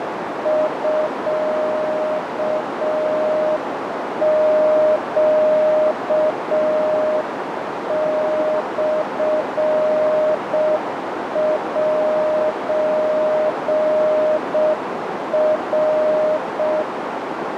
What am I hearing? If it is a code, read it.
Morse code (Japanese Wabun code), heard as a keyed tone, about 6 wpm, 620 Hz, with heavy radio static and a narrow filter. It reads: ミネモセナ